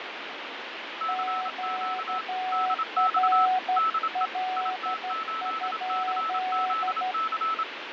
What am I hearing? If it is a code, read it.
Morse code, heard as two keyed tones, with radio static and fading. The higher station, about 27 wpm, 1310 Hz: CQ DX DE IT8CZC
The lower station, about 12 wpm, 740 Hz: QRL?